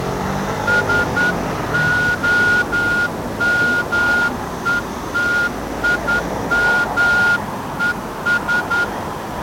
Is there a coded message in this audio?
Yes: Morse code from 0.6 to 8.9 s, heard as a whistle, hand-sent with a straight key, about 10 wpm, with street noise. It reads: SOMETIMES